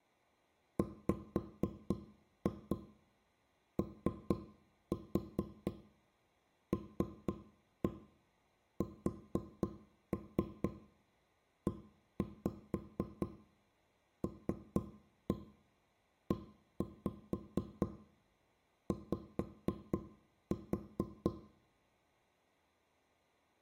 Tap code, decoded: WOLSELEY

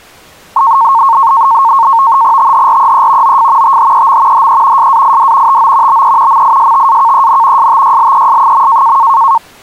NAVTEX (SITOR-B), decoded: THREE OF THEM HE SAID TO BE MISTAKEN STYLES.

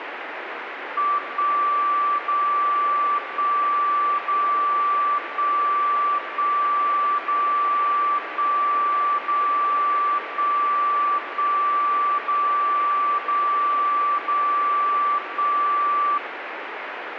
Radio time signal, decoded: 1 0 1 0 1 1 0 1 0 1 1 0 0 0 1

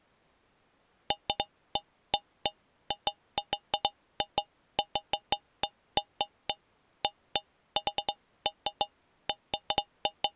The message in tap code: none

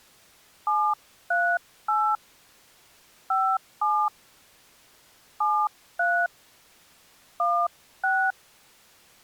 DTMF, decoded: 738 57 73 16

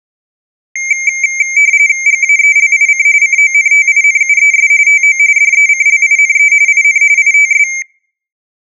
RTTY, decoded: GAELIC CONTINUES TO DECLINE IN ITS

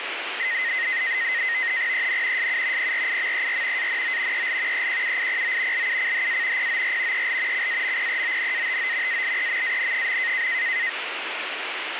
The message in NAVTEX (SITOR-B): EN SU PRIMER ANO EL EQUIPO LUCHA POR EL CAMPEONATO ALEMAN.

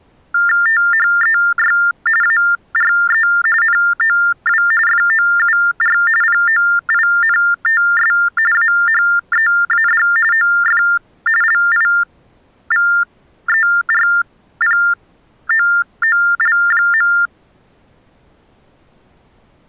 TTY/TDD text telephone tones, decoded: THEY ARE NOW FOUR POINTS AHEAD OF LIVERPOOL.

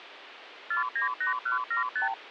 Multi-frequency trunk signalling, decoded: 498175

